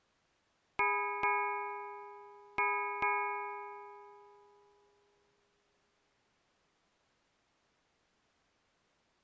Ship's bell, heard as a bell. 4. Four half-hours of the watch have passed.